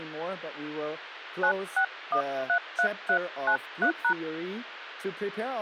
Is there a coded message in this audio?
Yes: DTMF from 1.4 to 4.1 s, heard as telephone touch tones, dialled by hand, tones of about 80 ms, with phone line noise. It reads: 96133393#